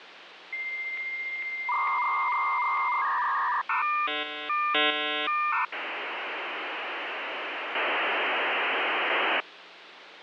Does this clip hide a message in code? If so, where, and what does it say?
Yes: dial-up modem handshake (V.34 or later) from 0.5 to 9.4 s, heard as a whistle, warbles, then hiss, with phone line noise.